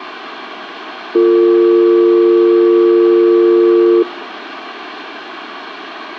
Telephone call progress tone (North American or UK plan), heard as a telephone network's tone, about 350, 450 Hz, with room echo. Dial tone.